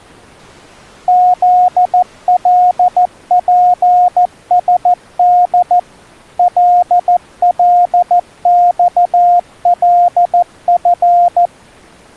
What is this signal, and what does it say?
Morse code, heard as a keyed tone, machine-sent, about 14 wpm, 710 Hz. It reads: ZLPSD LLXLF